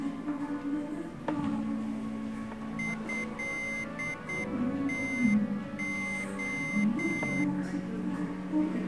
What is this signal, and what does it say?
Morse code (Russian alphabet), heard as a high beeper, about 8 wpm, 2100 Hz, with the noise of a cafe. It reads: ЭТО